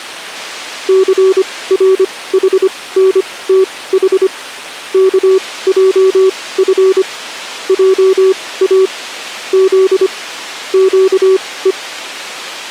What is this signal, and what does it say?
Morse code, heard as a keyed tone, machine-sent, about 25 wpm, spaced as for 18 wpm, 380 Hz. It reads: CRHNTH KJF JA Z QE